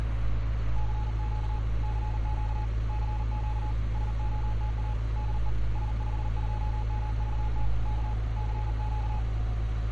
Morse code, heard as a keyed tone, hand-sent with a paddle, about 39 wpm, 850 Hz, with street noise. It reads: CQ CQ CQ SOTA DE S52MVT K CQ